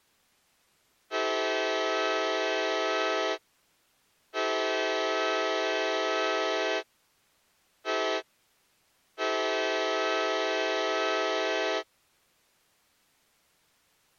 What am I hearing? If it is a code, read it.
Train horn signal, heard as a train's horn. 2 long, 1 short, 1 long. On North American railways: approaching a public crossing.